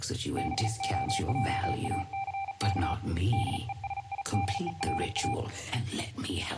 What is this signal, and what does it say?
Morse code, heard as a keyed tone, hand-sent with a paddle, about 37 wpm, 790 Hz, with room echo. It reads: BOJACK DESIDERA